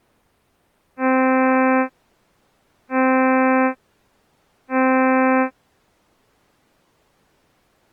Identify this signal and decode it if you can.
Ship horn signal, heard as a ship's horn, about 260 Hz. 3 short. At sea: I am operating astern propulsion.